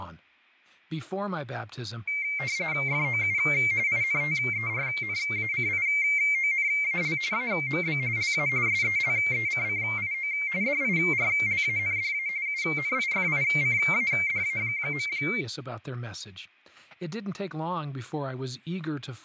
RTTY (45.45 baud, 170 Hz shift), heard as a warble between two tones, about 2200 Hz centre, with speech in English. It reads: FOU INTERNACIONAL AMB LA SELECCIO DIRLANDA UNIFICADA.